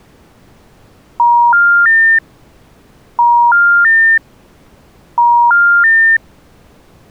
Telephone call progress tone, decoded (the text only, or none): special information tone